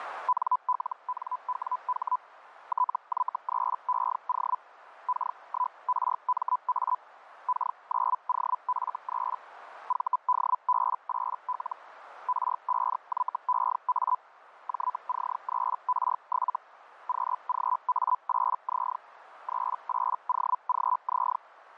Hellschreiber (Feld-Hell, 122.5 baud), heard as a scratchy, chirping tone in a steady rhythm, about 1000 Hz, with radio static. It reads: NLNWH TY3EO K1RMA K9OF3 VDB8L R5YEA JC3R7 QGA8Z 38OGZ